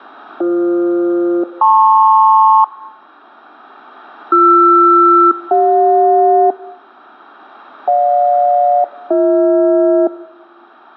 Aircraft SELCAL, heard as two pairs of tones. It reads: BF-LP BR-CJ GJ-BH